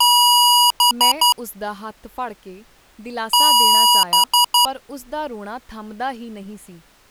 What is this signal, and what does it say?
Beep code, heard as beeps from a small speaker, played twice, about 970 Hz, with speech in Punjabi. 1 long, 3 short. In Award and IBM BIOS tables: video adapter failure; in AMI BIOS tables: memory failure.